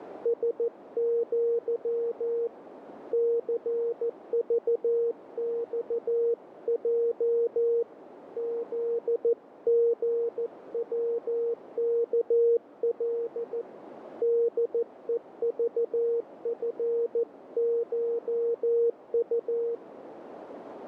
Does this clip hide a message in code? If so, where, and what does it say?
Yes: Morse code (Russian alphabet) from 0.2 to 19.8 s, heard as a keyed tone, hand-sent with a paddle, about 14 wpm, 470 Hz, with radio static and a narrow filter. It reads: СЪ ЦЖЬЙ ЗГВКЛ ДЕЖФШУ